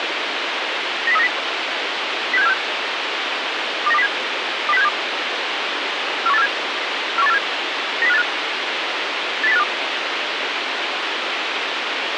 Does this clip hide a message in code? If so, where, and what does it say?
Yes: five-tone selective call (EEA) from 1.1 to 9.6 s, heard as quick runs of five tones, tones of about 40 ms, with radio hiss. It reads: 90390 06746 29207 20672 41847 41847 90585 80852